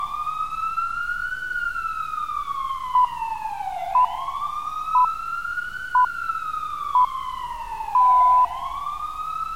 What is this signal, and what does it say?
Radio time signal (six pips, as the Greenwich Time Signal), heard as pips, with street noise.